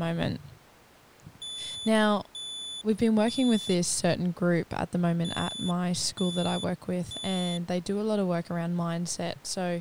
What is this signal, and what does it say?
Alarm pattern, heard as an alarm's beeps, played twice, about 3500 Hz, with speech in English. Temporal three. Smoke or fire, evacuate.